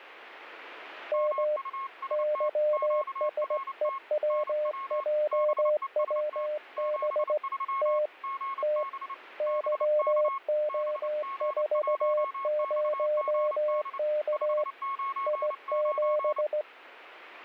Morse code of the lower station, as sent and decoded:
-- / -.-- ... . .-- .--- .-- -... / - / - / -.-- --- ....- ----- -.- / .. --...
M YSEWJWB T T YO40K I7

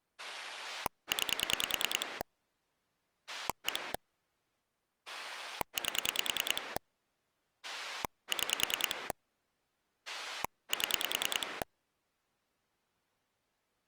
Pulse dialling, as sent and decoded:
9 / 1 / 8 / 6 / 7
9 1 8 6 7

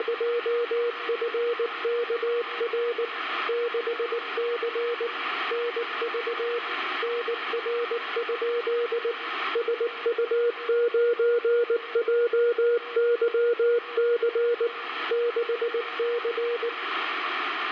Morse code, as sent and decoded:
… / -.... -.-. / -. ...- / -. .-. ..--.. / ... ..- ----. .--- -.-- -.-. / -.... -.-.
… 6C NV NR? SU9JYC 6C

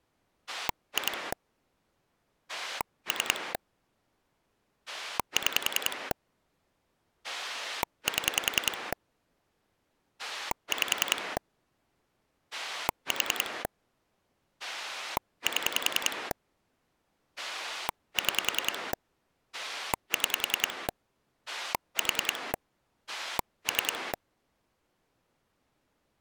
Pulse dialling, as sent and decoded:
2 / 3 / 6 / 7 / 5 / 4 / 7 / 6 / 6 / 4 / 3
2 3 6 7 5 4 7 6 6 4 3

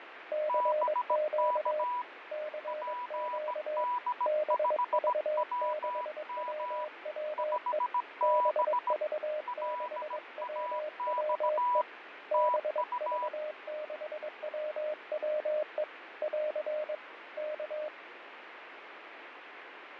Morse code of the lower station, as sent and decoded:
-.-. --.- / -.-. --.- / -... ...- -.... .-- .-- . / -... ...- -.... .-- .-- . / -... ...- -.... .-- .-- . / .-.-. / -.-
CQ CQ BV6WWE BV6WWE BV6WWE <AR> K

